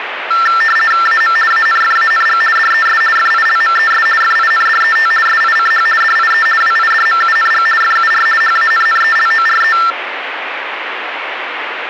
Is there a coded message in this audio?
Yes: RTTY (50 baud, 450 Hz shift) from 0.3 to 9.9 s, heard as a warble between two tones, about 1550 Hz centre, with radio static. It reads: AM ANFANG DES FILMES FINDET SICH DIE WIDMUNG FUR HANNELORE